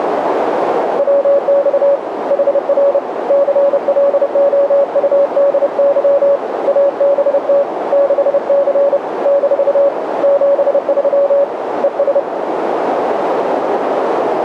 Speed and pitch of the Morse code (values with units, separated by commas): 30 wpm, 560 Hz